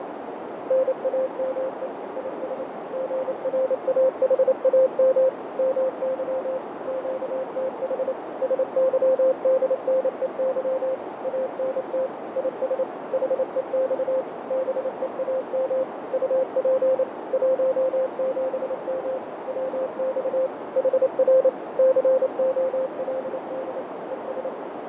Morse code, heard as a keyed tone, machine-sent, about 28 wpm, 520 Hz, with heavy radio static, fading and a narrow filter. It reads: NAME IS GRAHAM MY QTH SYDNEY ANT IS HEX BEAM UP 17M WX HR COLD ES